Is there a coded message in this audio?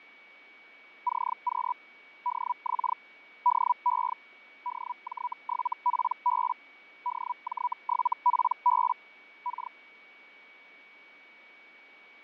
Yes: Hellschreiber (Feld-Hell, 122.5 baud) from 1.1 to 9.7 s, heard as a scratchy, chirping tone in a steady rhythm, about 980 Hz, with fading and a steady whistle near 2260 Hz. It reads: CQ DX DE DJ7PB DJ7PB K